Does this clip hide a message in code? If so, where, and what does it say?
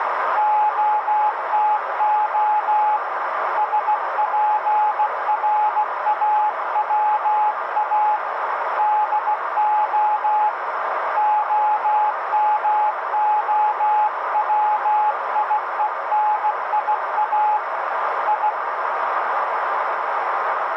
Yes: Morse code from 0.3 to 18.6 s, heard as a keyed tone, hand-sent with a bug key, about 16 wpm, 850 Hz, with radio static and a narrow filter. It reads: OTO SPRAWA DO OMOWIENIA I